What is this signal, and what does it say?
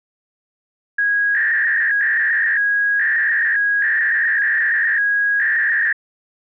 300-baud modem data (V.21 tones), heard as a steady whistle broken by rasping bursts, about 300 baud, 200 Hz shift.